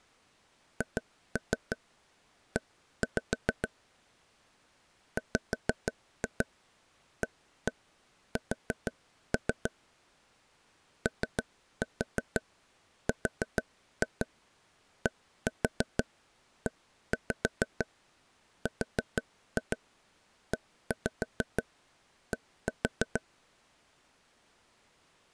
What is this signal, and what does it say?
Tap code, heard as taps on a table, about 6 knocks a second. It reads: HE WAS ORDERED